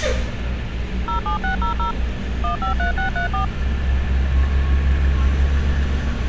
DTMF, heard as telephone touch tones, dialled by machine, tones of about 120 ms, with street noise. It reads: 07600 153634